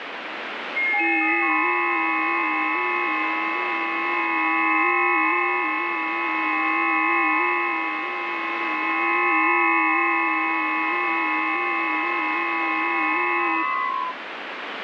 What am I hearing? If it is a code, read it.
FT8 (several signals at once), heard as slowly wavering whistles, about 6.25 baud, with heavy radio static.